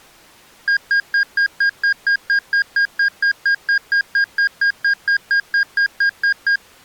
Evenly repeated beeps. There is no code.